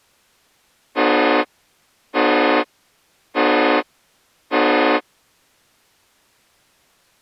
Train horn signal, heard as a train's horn. 4 short. On North American railways: a request for a signal to be given or repeated.